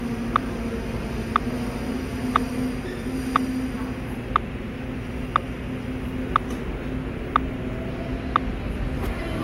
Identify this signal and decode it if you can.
Radio time signal (WWVH, Hawaii), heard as ticks, one a second, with the noise of a subway station.